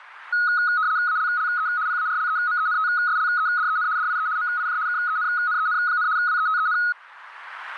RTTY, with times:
1.1-1.7 ALLE
1.9-3.9 PARLEMENTSLEDEN
4.0-4.3 DIE
4.4-4.8 MIJ
4.9-6.1 KENNEN,
6.2-6.8 WETEN

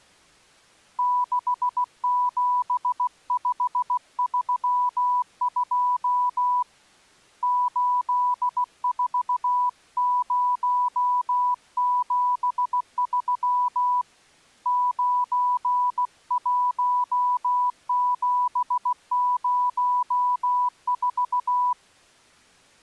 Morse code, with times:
1.0-6.6 67532
7.4-14.0 84073
14.7-21.7 91704

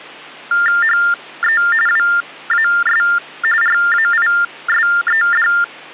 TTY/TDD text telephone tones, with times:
0.8-1.6 HE
1.9-3.0 WAS
3.6-5.5 RAISED

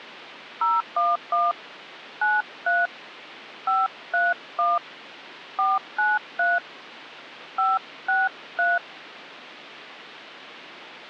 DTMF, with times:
0.6-1.5 011
2.2-2.9 93
3.7-4.8 531
5.6-6.6 493
7.6-8.8 563

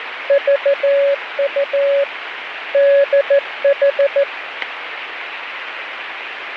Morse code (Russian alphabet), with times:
0.3-2.0 ЖУ
2.7-4.2 ДХ

